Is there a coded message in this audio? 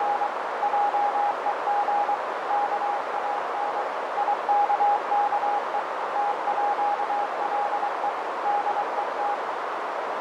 Yes: Morse code (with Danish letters) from 0.0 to 9.4 s, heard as a keyed tone, machine-sent, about 23 wpm, 820 Hz, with heavy radio static, fading and a narrow filter. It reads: … JEG KAN IKKE TÅLE DET